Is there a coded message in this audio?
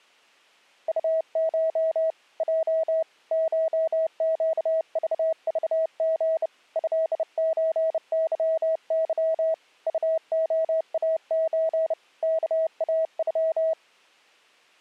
Yes: Morse code (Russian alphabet) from 0.8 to 13.8 s, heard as a keyed tone, hand-sent with a bug key, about 30 wpm, 640 Hz. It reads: УШ Й ШЩЖЖГ ЭЧЫЫ УОАЧ КАЮ